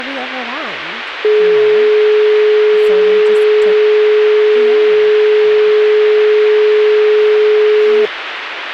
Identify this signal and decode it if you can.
Telephone call progress tone (425 Hz plan, as in most of Europe), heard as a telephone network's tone, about 420 Hz, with phone line noise and speech in English. Dial tone.